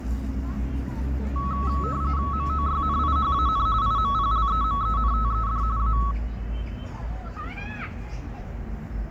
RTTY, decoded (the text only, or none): MOYNIHAN IMPLEMENTED A